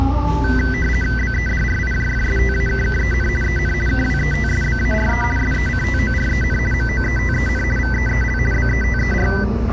RTTY (50 baud, 450 Hz shift), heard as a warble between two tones, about 1750 Hz centre, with the noise of a cafe. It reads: BEDRIJFSTAKKEN EN KWETSBARE SECTOREN MOETEN VEEL BETER